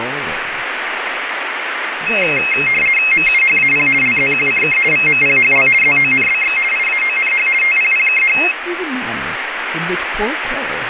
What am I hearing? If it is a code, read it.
RTTY (50 baud, 450 Hz shift), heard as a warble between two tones, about 2350 Hz centre, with radio static and speech in English. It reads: MUHAP LZQCK VMPHL ZONBX IAONH TPPKH